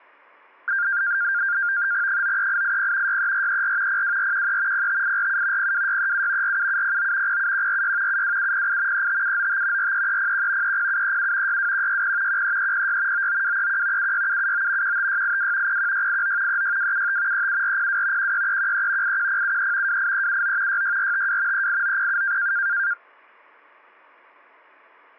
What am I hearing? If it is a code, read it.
NAVTEX (SITOR-B), 100 baud, 170 Hz shift, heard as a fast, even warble, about 1500 Hz centre. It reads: 93880 63434 02413 05847 02637 47709 07146 72708 35795 43301 30737 62160 13306 99231 76779 15682 01689 36275 37402 16313 81073 28379 66452 38907